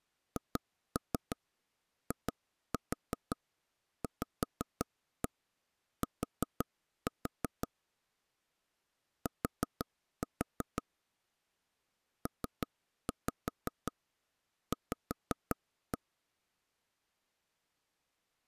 Tap code, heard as taps on a table, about 5 knocks a second. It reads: HIVT T PV